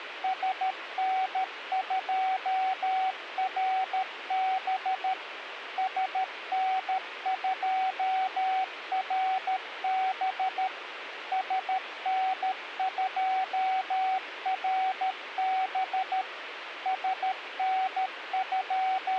Morse code, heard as a keyed tone, machine-sent, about 13 wpm, 760 Hz, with radio hiss. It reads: SN2RB SN2RB SN2RB …